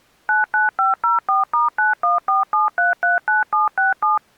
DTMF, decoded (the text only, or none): 99504*9147339767